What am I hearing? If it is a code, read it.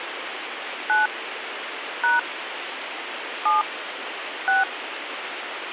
DTMF, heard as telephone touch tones, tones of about 160 ms, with radio hiss. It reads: 9 # 7 6